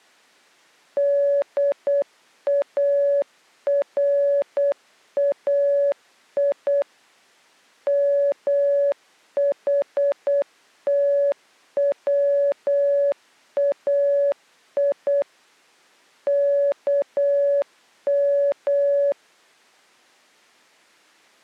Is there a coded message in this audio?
Yes: Morse code (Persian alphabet) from 0.9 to 19.2 s, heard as a keyed tone, machine-sent, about 8 wpm, 570 Hz. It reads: دارای محتوای کم